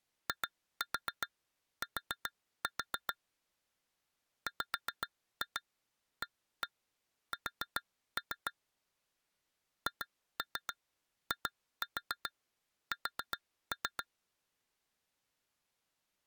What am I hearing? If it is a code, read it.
Tap code, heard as taps on glass, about 7 knocks a second. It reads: IT WAS HIS